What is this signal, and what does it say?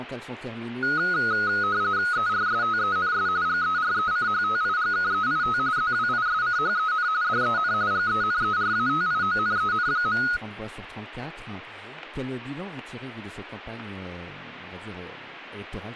RTTY (45.45 baud, 170 Hz shift), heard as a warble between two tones, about 1360 Hz centre. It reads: ERSTENS GERECHTIGKEIT ZWISCHEN DEN GENERATIONEN.